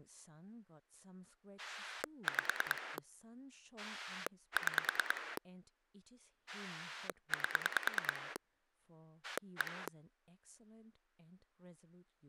Pulse dialling, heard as a rotary dial, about 9 pulses a second, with speech in English. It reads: 5 6 8 1